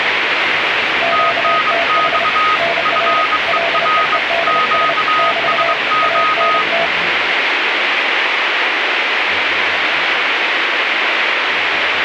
Morse code, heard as two keyed tones, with radio static. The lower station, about 30 wpm, 680 Hz: QTH NR LEEDS <BT> ANT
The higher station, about 23 wpm, 1250 Hz: TNX FER QSO